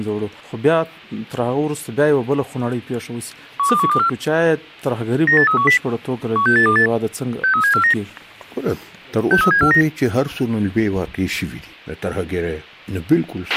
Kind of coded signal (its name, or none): five-tone selective call